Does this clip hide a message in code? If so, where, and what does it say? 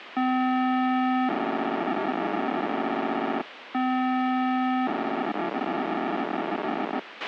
Yes: POCSAG pager data (512 baud) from 0.2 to 7.0 s, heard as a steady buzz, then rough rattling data, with radio hiss and a squelch burst at the end.